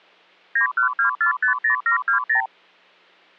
Multi-frequency trunk signalling (R2, with the far end's replies), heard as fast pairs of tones, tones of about 110 ms. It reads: 912450720